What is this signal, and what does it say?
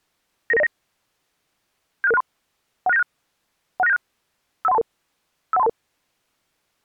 Five-tone selective call (EIA), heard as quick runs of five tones, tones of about 30 ms. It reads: 99909 76663 16976 16976 51322 51322